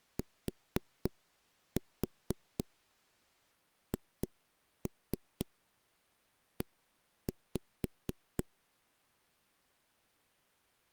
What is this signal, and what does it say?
Tap code, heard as knocks on a wall, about 4 knocks a second. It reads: THE